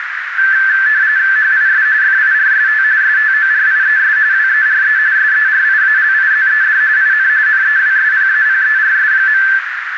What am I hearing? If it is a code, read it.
RTTY (45.45 baud, 170 Hz shift), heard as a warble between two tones, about 1650 Hz centre, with radio static and a narrow filter. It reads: HIS FIRST STORIES WERE SERIALIZED IN NEWSPAPERS.